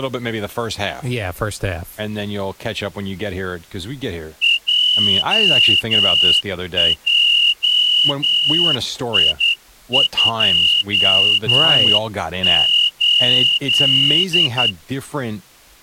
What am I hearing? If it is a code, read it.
Morse code, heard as a whistle, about 10 wpm, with speech in English. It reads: JJI28